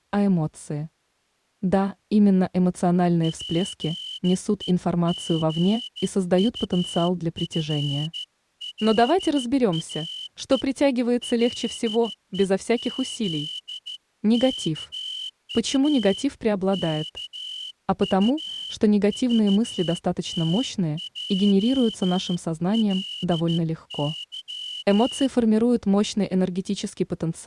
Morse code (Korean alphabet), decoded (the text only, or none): 자신과 같이 이렇게